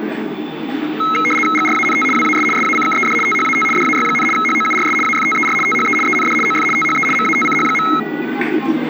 RTTY (75 baud, 850 Hz shift), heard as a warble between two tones, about 1700 Hz centre, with the noise of a park. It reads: GRANT WAS SACKED THAT DAY, HOURS AFTER THE END OF THE MATCH.